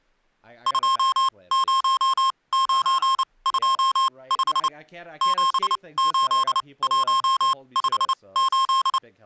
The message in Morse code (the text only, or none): 20925 78158